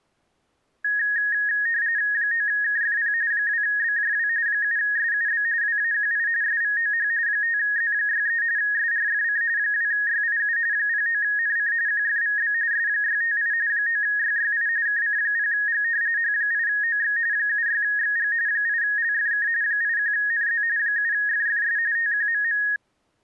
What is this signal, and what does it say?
RTTY (45.45 baud, 170 Hz shift), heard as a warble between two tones, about 1750 Hz centre. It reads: 9KFP 2BJW 7SUB WAQI SVOH 5Z63 SRFC 2YIU 09NC QFVB S658 9YYI KC0G H8OX 76XG 8LFK 81NZ 7FFS TQMM